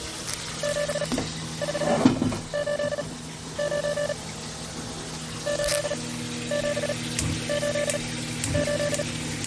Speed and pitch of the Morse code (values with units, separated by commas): 38 wpm, spaced as for 13 wpm, 580 Hz